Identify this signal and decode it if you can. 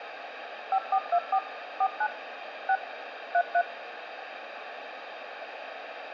DTMF, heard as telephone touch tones, dialled by machine, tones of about 60 ms, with radio hiss and room echo. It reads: 5424 49 6 33